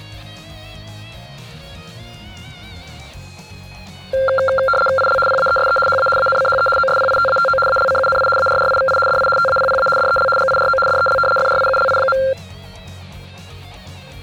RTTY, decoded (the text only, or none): IL PAESE HA ANCHE OSPITATO ALCUNI ARRIVI DI TAPPA DEL GIRO DEL FRIULI.